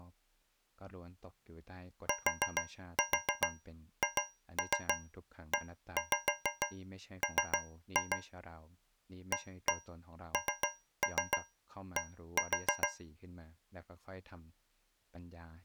Tap code, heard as taps on a metal pipe, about 6 knocks a second, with speech in Thai. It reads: THEM AND